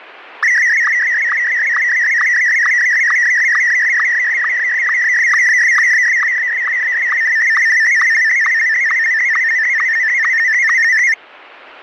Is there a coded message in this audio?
Yes: SSTV (slow-scan television), Martin M1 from 0.4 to 11.1 s, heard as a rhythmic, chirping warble, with radio static.